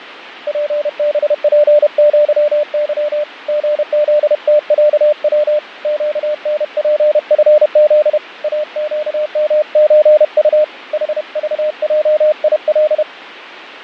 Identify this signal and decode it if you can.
Morse code (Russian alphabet), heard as a keyed tone, hand-sent with a paddle, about 31 wpm, 600 Hz, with radio static and fading. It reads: ПБПЪЫ ГЗТЯВ ЩНПФЗ АЩМЧУ ХЖЙИЛ